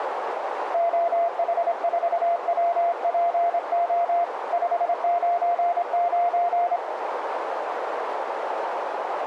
Morse code, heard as a keyed tone, hand-sent with a straight key, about 26 wpm, 690 Hz, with radio static and a narrow filter. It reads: OH4WPO 599